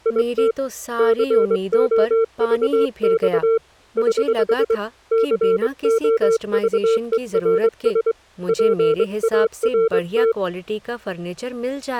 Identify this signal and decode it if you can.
Morse code, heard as a keyed tone, hand-sent with a straight key, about 23 wpm, 450 Hz, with speech in Hindi. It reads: IT COVX <HH> COVERS PART